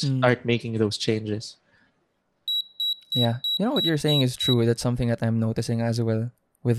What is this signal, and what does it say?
Beep code, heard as a piezo beeper, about 3900 Hz, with room echo and speech in English. 7 short. In AMI BIOS tables: virtual mode exception error; in Dell tables: processor failure.